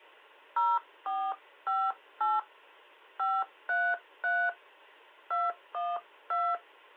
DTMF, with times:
0.6-2.4 0458
3.2-4.5 533
5.3-6.5 212

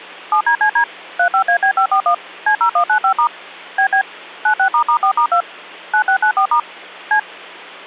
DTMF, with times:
0.3-0.8 7DCD
1.2-2.1 35AB541
2.5-3.3 C0195*
3.8-4.0 BB
4.5-5.4 96**4*2
5.9-6.6 9694*
7.1-7.2 C

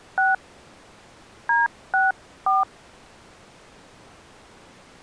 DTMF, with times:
0.2-0.3 6
1.5-2.6 D64

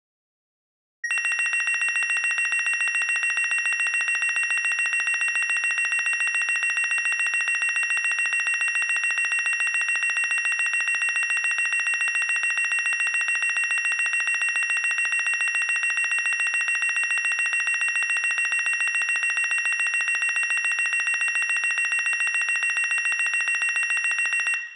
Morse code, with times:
none

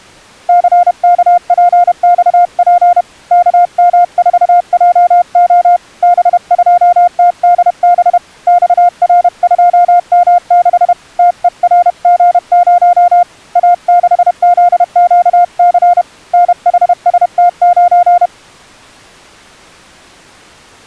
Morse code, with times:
0.5-3.0 CKPXP
3.3-5.8 KM4JO
6.0-8.2 B2TDB
8.5-10.9 XR2M6
11.2-13.2 TERG0
13.6-16.0 A6ZQC
16.3-18.3 NHST9

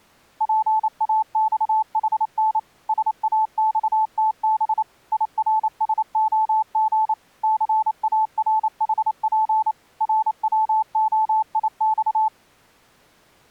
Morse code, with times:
0.4-2.6 PAXHN
2.9-4.8 SAXTB
5.1-7.1 IRSOG
7.4-9.7 CARHP
10.0-12.3 RWOIX

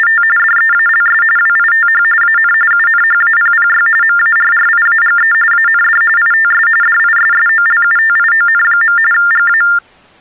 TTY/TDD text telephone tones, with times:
0.0-0.2 …
0.4-1.2 DEALS
1.4-2.0 WITH
2.2-2.5 AN
2.7-3.9 UNHAPPY
4.0-5.3 MARRIAGE
5.5-6.0 AND
6.2-6.7 ITS
6.8-9.0 DISSOLUTION.
9.1-9.6 GA

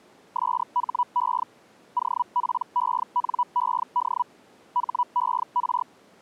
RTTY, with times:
none

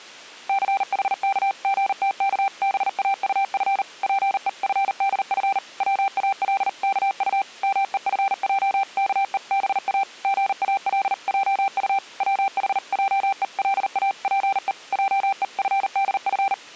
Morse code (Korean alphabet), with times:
0.5-3.8 충성된
4.0-5.6 자는
5.8-7.4 복이
7.6-10.0 많아도
10.2-12.0 속히
12.2-14.7 부하고자
14.9-16.5 하는

